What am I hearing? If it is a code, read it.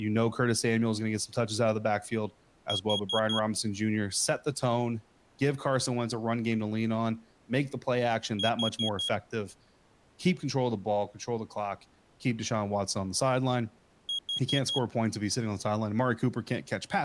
Alarm pattern, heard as an alarm's beeps, played three times, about 3300 Hz, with speech in English. Temporal four. Carbon monoxide.